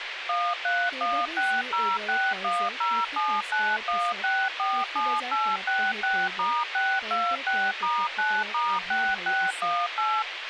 DTMF, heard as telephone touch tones, dialled by machine, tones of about 250 ms, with radio hiss and speech in Assamese. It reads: 13160610791647866*626*9*6618